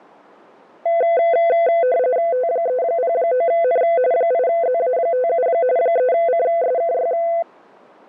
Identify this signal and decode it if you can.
RTTY (45.45 baud, 170 Hz shift), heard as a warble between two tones, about 590 Hz centre. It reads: T309N 8ZA57 3CSKY